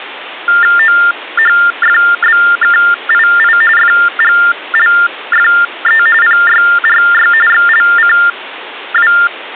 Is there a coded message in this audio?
Yes: TTY/TDD text telephone tones (45.45 baud Baudot) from 0.5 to 9.3 s, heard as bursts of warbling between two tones, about 400 Hz shift, 1600 Hz centre, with phone line noise. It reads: OHFBKII FGLFE PYRY XLCW